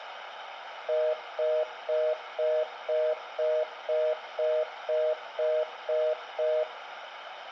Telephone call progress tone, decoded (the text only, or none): congestion tone